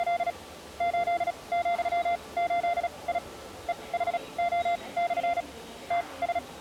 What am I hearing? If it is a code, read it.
Morse code, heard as a keyed tone, machine-sent, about 36 wpm, spaced as for 25 wpm, 690 Hz, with the noise of a subway station. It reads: … 8,8I EHO/ …